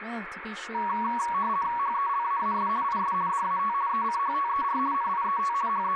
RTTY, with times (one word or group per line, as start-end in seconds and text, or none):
1.8-2.7 HELAAS
2.8-3.1 IS
3.3-3.7 DAT
3.9-4.8 ECHTER
4.9-5.5 NIET
5.7-6.0 …